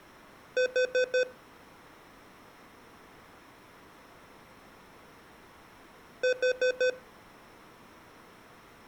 Alarm pattern, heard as an alarm's beeps, played twice, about 510 Hz. Temporal four. Carbon monoxide.